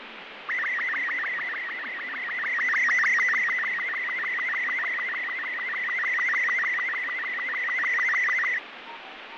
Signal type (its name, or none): SSTV (slow-scan television)